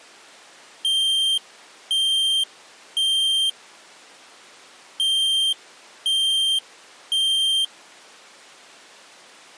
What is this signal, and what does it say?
Alarm pattern, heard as an alarm's beeps, played twice, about 3150 Hz. Temporal three. Smoke or fire, evacuate.